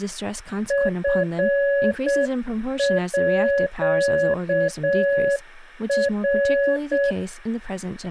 Morse code (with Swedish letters), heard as a keyed tone, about 7 wpm, 560 Hz, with speech in English. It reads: FÅR